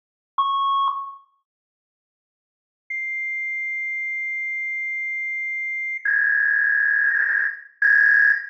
Fax machine handshake, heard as a beep, a long tone and a warble, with room echo.